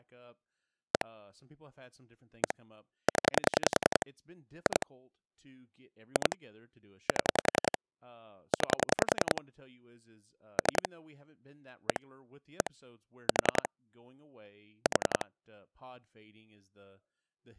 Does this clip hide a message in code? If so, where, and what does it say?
Yes: pulse dialling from 0.9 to 15.2 s, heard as clicks on a phone line, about 10 pulses a second, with speech in English. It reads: 1 1 0 2 2 7 9 3 1 1 4 4